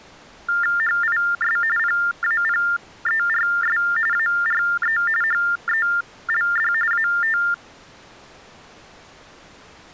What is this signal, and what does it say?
TTY/TDD text telephone tones (45.45 baud Baudot), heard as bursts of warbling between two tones, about 400 Hz shift, 1600 Hz centre. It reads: HIS PAPERS ARE HELD AT